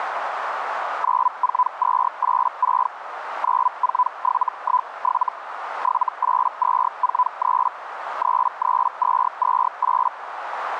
Hellschreiber (Feld-Hell, 122.5 baud), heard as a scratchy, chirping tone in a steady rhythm, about 1000 Hz, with radio static and a narrow filter. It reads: 94286 94717 78243 33228